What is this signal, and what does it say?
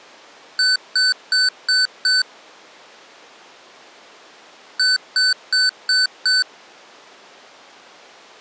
Beep code, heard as beeps from a small speaker, played twice, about 1500 Hz. 5 short. In AMI BIOS tables: processor failure; in Dell tables: CMOS battery failure.